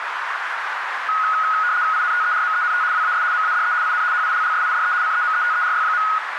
RTTY (75 baud, 170 Hz shift), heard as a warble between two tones, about 1360 Hz centre, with radio static and a narrow filter. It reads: INTERMENT WAS MADE IN HILLSIDE CEMETERY.